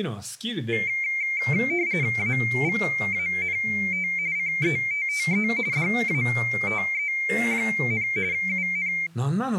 RTTY (45.45 baud, 170 Hz shift), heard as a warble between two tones, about 2200 Hz centre, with speech in Japanese. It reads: AVANT CETTE DATE, UN